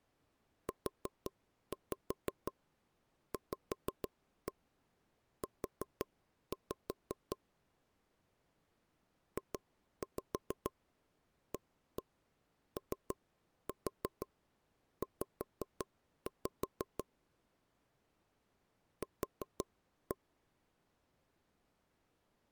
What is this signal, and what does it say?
Tap code, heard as taps on a table, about 6 knocks a second. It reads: UVU JAOZ Q